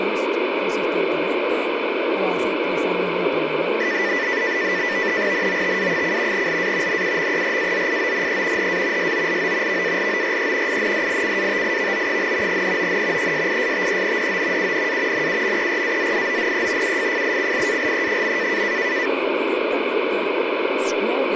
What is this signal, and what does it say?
NAVTEX (SITOR-B), 100 baud, 170 Hz shift, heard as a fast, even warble, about 1900 Hz centre, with radio static and speech in Spanish. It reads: NOTA: LA NUMERAZIONE HA SOLO VALORE INDICATIVO, NON ESISTENDO UNA NUMERAZIONE UFFICIALE.